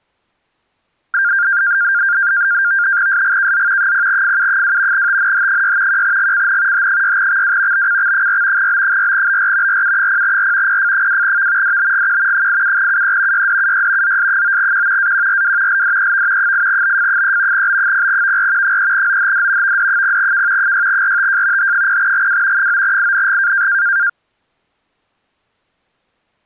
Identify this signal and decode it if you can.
NAVTEX (SITOR-B), 100 baud, 170 Hz shift, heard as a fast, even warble, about 1500 Hz centre. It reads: SGKZ 0FU2 TNH6 1GCN H6XW BCX4 B4BR RU0R PF2V DBGQ 87UE YDUY ZS9Q AQRW LDEV 8BF3 B0VR 3OHD VD0K 6RTJ H0GW 9ING